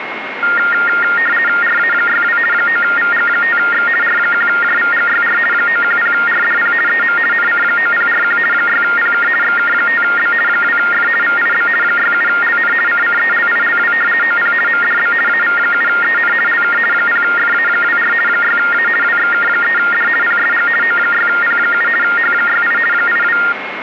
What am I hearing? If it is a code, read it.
RTTY (50 baud, 450 Hz shift), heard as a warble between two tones, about 1650 Hz centre, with radio static and a steady whistle near 2160 Hz. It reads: RA62 9VG5X R1JVGYR 910RDP EM NC9041 6PK XK5B 2F VIB 67LN CCELILW OP MDB AV7EN LK 0FA24 6A WXK3D PSG O6P7 H68 82